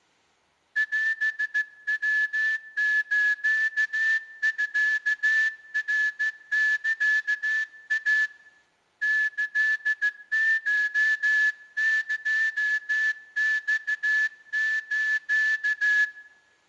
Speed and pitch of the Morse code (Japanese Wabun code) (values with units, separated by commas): 14 wpm